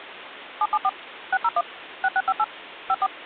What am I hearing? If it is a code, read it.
DTMF, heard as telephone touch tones, dialled by machine, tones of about 50 ms, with phone line noise. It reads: 774 601 6658 54